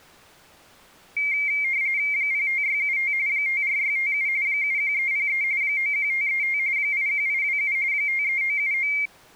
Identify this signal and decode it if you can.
RTTY (45.45 baud, 170 Hz shift), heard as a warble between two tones, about 2200 Hz centre. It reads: 05675 54657 71303 91535 81827 53979